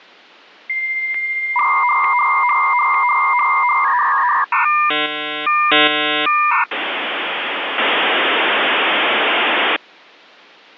Dial-up modem handshake (V.34 or later), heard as a whistle, warbles, then hiss.